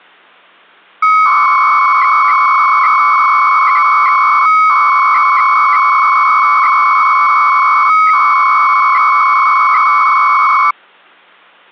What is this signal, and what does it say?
300-baud modem data (Bell 103 tones), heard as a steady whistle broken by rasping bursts, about 300 baud, 200 Hz shift.